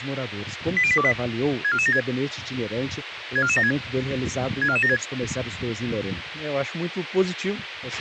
Five-tone selective call (ZVEI), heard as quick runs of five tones, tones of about 70 ms, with radio hiss and a squelch burst at the end. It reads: 80828 64476 64476 64476